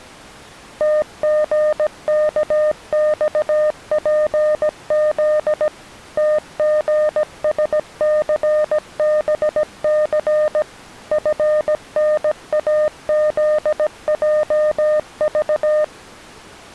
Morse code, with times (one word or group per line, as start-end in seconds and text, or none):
0.8-5.7 TGKXPZ
6.2-10.6 TGSCBC
11.1-15.8 FNAZJV